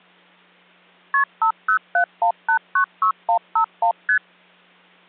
Multi-frequency trunk signalling (R1, as on North American trunks), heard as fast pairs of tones, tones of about 90 ms. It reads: KP 5071896151 ST